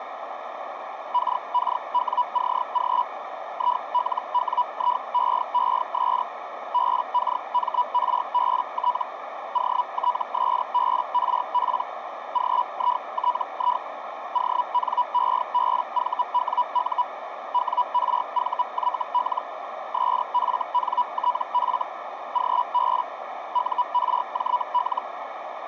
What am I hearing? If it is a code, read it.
Hellschreiber (Feld-Hell, 122.5 baud), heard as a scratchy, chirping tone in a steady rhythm, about 980 Hz, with radio static and a narrow filter. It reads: KKWCG ILWIEES BKMRBT OTSBRP GITI ONEBVWU WRVYL SFNTF GB URJL